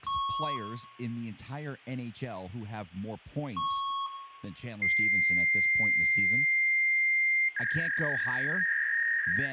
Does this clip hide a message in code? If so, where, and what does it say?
Yes: fax machine handshake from 0.1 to 9.5 s, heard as beeps, a long tone and a warble, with room echo and speech in English.